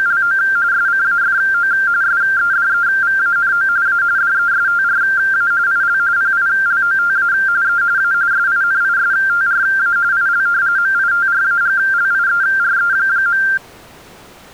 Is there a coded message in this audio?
Yes: RTTY (45.45 baud, 170 Hz shift) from 0.0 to 13.6 s, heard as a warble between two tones, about 1480 Hz centre. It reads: … SCAFO SEDEVANO A DESTRA IL PILOTA E A SINISTRA IL MITRAGLIERE.